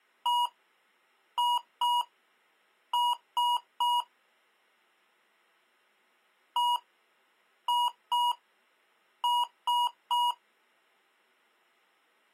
Beep code, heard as beeps from a small speaker, played twice, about 960 Hz. 1-2-3. In Phoenix BIOS tables: DMA page register failure.